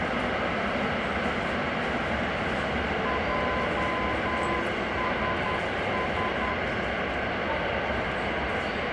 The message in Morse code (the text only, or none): JSS